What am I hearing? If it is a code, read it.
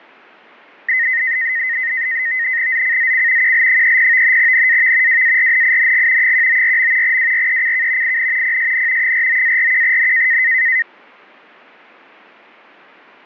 NAVTEX (SITOR-B), 100 baud, 170 Hz shift, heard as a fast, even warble, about 1950 Hz centre. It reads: ZCZC QL30 NAV WARNING 194. WRECK IN PSN 49-41N